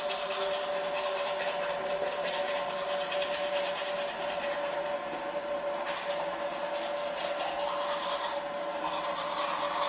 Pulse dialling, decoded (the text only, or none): none